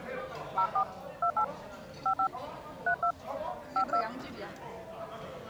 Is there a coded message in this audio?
Yes: DTMF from 0.6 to 4.0 s, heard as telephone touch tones, dialled by hand, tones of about 80 ms, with the noise of a crowd indoors. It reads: 04 28 55 32 52